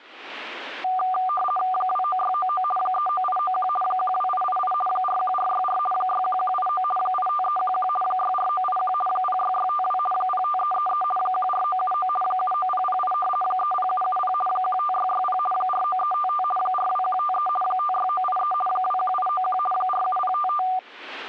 RTTY (50 baud, 450 Hz shift), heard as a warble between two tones, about 970 Hz centre. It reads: 29699 39891 12888 41464 61189 85311 64981 06652 05333 14979 79008 30770 15660 49355 42153 56983 21891 47055